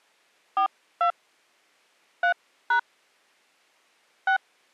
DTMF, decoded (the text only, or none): 42 3# 6